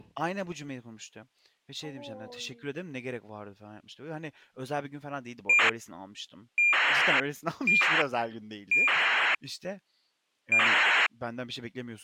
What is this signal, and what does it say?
ACARS aircraft data, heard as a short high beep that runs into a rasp, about 2400 baud, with speech in Turkish.